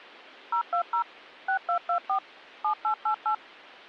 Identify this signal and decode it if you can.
DTMF, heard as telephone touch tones, dialled by machine, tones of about 90 ms. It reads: 020 6224 7888